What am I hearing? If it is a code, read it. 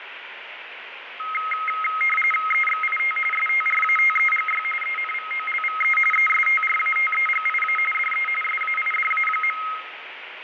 RTTY (45.45 baud, 850 Hz shift), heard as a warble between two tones, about 1700 Hz centre, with radio static and fading. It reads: EXIT STRATEGY ENVOLVE ESTRATEGIA DE SAIDA.